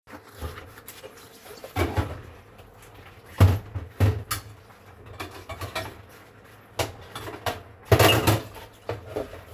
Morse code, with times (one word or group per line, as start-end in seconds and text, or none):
none